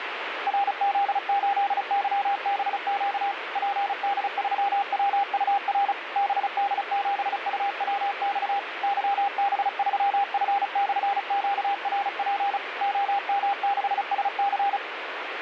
Morse code, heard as a keyed tone, machine-sent, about 35 wpm, 800 Hz, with radio static. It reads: RZ8YBQ PD3WUR BD7UWX YB3F/QRP OM6SC